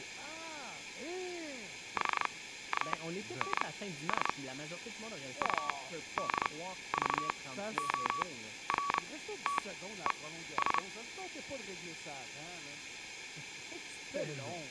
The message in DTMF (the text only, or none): none